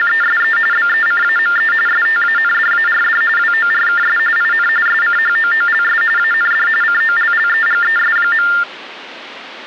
TTY/TDD text telephone tones (45.45 baud Baudot), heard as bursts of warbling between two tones, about 400 Hz shift, 1600 Hz centre. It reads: … BECAME STANDARD WORKS IN SCHOOLS AND COLLEGES.